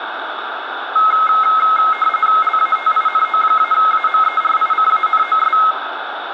RTTY (45.45 baud, 850 Hz shift), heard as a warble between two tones, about 1700 Hz centre, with radio static. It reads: LATINO-AMERICANOS